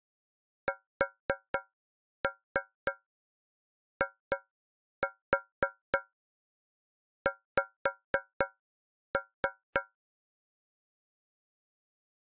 Tap code, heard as taps on a metal pipe, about 4 knocks a second. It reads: SIX